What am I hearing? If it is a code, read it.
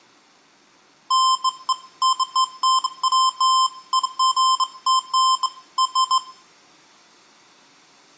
Beeps of irregular length, with room echo. There is no code.